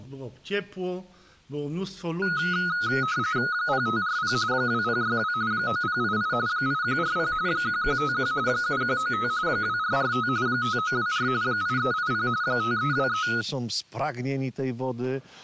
RTTY (45.45 baud, 170 Hz shift), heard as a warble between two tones, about 1360 Hz centre. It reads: 0540 2062 9088 8140 1151 7195 2445 5924 8380 5323